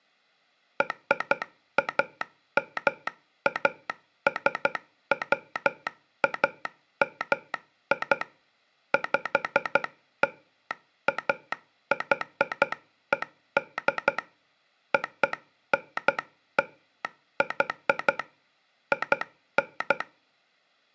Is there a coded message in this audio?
Yes: Morse code (American railroad code) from 0.7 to 20.1 s, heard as a telegraph sounder, hand-sent with a straight key. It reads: RAMASWAMI PLAYED ONLY IN